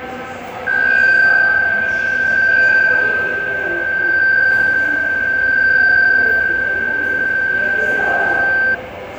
PSK63 (62.5 baud), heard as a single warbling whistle, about 1550 Hz, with fading, room echo and the noise of a subway station.